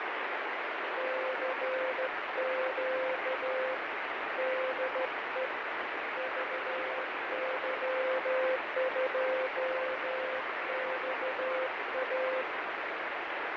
Morse code, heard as a keyed tone, hand-sent with a straight key, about 13 wpm, 520 Hz, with heavy radio static and fading. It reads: CQ DE VY2XA